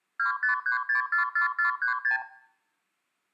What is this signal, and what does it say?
Multi-frequency trunk signalling (R2, with the far end's replies), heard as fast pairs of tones, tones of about 120 ms, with room echo. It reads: 253644436